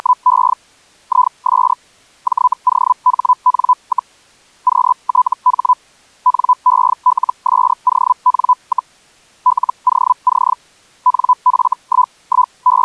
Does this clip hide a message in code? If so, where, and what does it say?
Yes: Hellschreiber (Feld-Hell, 122.5 baud) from 0.0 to 12.8 s, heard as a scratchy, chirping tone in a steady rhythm, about 1000 Hz. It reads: … IS JOHN, QTH NELSON, LOC …